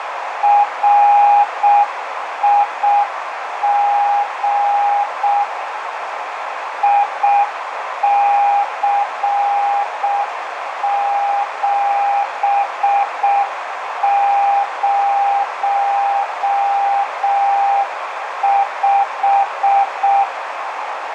Morse code, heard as a keyed tone, machine-sent, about 6 wpm, 810 Hz, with radio static and a narrow filter. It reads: RIG IC705